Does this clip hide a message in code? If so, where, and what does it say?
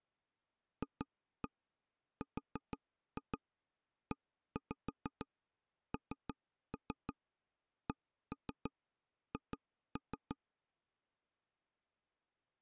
Yes: tap code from 0.8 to 10.4 s, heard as taps on a table, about 6 knocks a second. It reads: FRENCH